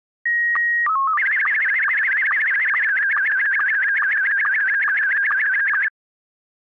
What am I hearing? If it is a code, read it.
SSTV (slow-scan television), Scottie S1, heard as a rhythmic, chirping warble.